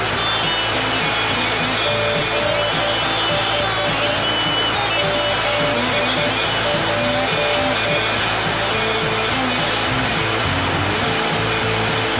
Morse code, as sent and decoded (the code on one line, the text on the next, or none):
--. .... / --.. .--.
GH ZP